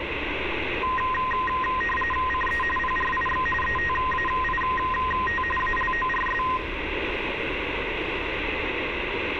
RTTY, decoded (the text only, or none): CE PRIX ETAIT ALORS